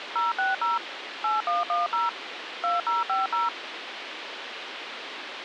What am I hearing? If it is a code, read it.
DTMF, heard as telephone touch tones, dialled by machine, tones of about 160 ms, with radio hiss. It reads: 060 8110 2050